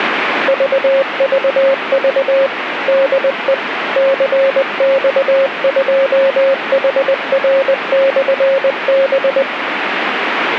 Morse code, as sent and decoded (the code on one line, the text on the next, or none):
...- ...- ...- / -.. . / -.-. -..- ..--- .... .-. -..-. -...
VVV DE CX2HR/B